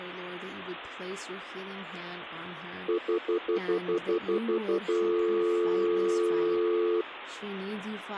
Telephone call progress tone (North American plan), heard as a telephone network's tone, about 350, 440 Hz, 0.1 s on and 0.1 s off, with speech in English. Stutter dial tone.